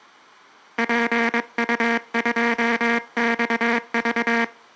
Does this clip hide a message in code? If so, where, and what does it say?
Yes: Morse code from 0.7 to 4.5 s, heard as a buzzer, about 22 wpm. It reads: PU2XV